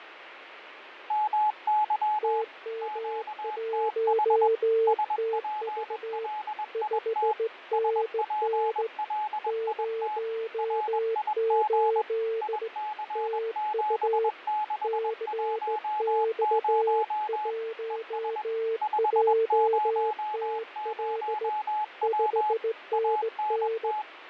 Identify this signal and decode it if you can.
Morse code, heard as two keyed tones, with radio static and fading. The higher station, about 21 wpm, 850 Hz: MY QTH SPLIT SPLIT RIG IC7610 ES 500W ANT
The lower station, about 17 wpm, 450 Hz: TM1TV 5NN 08 TU CX1JTL 5NN